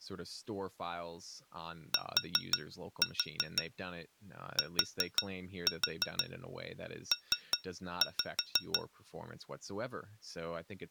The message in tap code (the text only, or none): TTP